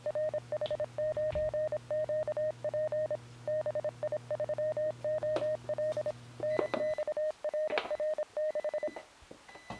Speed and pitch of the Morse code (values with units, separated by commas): 26 wpm, 620 Hz